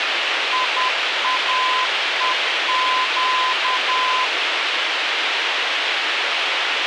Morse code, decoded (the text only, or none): IAEQ